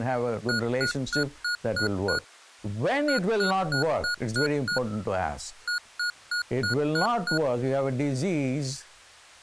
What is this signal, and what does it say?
Beep code, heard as beeps from a small speaker, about 1440 Hz, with speech in English. 6-6-6.